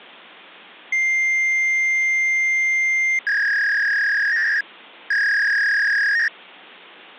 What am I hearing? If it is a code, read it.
Fax machine handshake, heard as a long tone and a warble.